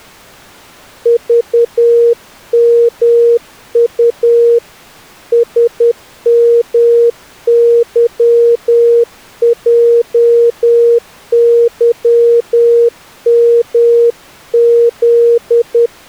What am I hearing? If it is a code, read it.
Morse code, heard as a keyed tone, hand-sent with a paddle, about 10 wpm, 470 Hz. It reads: VMU SMYJYMZ